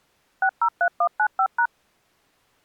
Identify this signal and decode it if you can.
DTMF, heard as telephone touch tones, dialled by machine, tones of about 70 ms. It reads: 603195#